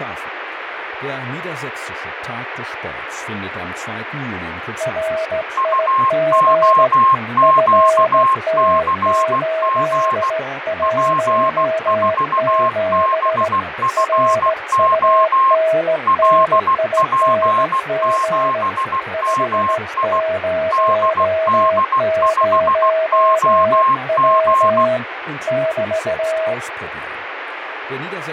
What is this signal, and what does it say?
Morse code, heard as two keyed tones, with radio static and speech in German. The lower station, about 17 wpm, 640 Hz: RIG FT817 RUNNING 500W <BT>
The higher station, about 16 wpm, 1060 Hz: UOQCG P4BFO LP7MI DD5OG